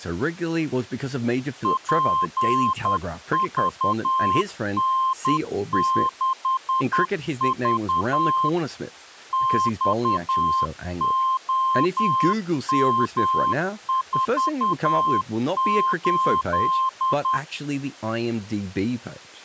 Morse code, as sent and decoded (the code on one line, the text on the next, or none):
.--. ...- -. -.... ...- / -..- --- -- ....- ---..
PVN6V XOM48